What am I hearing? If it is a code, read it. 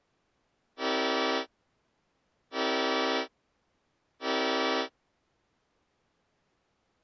Train horn signal, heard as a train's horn. 3 short. On North American railways: when stopped, the train will back up.